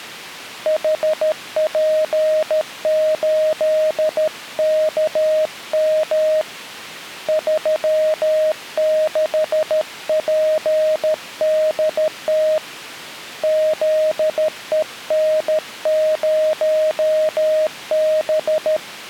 Morse code, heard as a keyed tone, hand-sent with a paddle, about 13 wpm, 620 Hz. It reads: HP8KM 36PDT ZEN0B